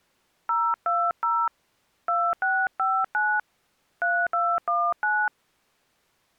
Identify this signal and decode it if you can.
DTMF, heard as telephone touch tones, dialled by hand, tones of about 250 ms. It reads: 020 2659 3219